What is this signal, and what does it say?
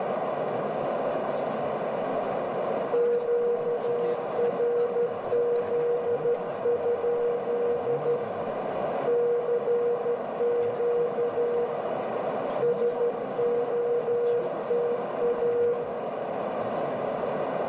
Morse code, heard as a keyed tone, hand-sent with a straight key, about 12 wpm, 480 Hz, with heavy radio static, a narrow filter, room echo and speech in Korean. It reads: QRZ? CQ SOTA